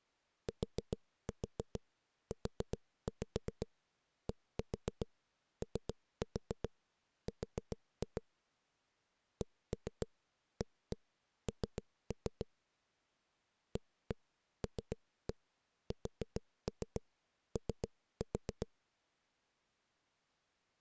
Tap code, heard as knocks on a wall, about 7 knocks a second. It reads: TUDOR CAN ALSO